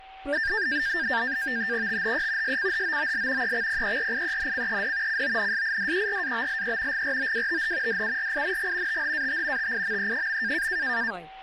NAVTEX (SITOR-B), 100 baud, 170 Hz shift, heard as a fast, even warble, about 1700 Hz centre, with a steady whistle near 770 Hz and speech in Bangla. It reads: THE SCHOOL EXPERIENCED CONSIDERABLE GROWTH DURING THAT TIME.